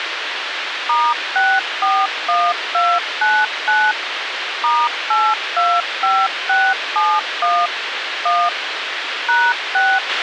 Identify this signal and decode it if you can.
DTMF, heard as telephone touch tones, dialled by machine, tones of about 240 ms, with radio hiss and a squelch burst at the end. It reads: *641299 *825671 1 #6